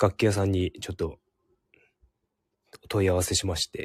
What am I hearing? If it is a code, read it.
Speech in Japanese. There is no code.